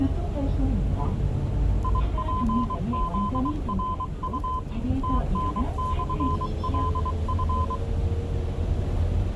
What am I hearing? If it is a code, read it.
Morse code, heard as a keyed tone, hand-sent with a paddle, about 23 wpm, 1020 Hz, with the noise inside a bus. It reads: IPZRU TN/LF